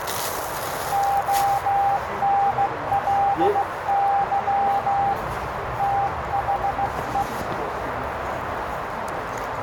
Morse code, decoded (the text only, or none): ONLY THE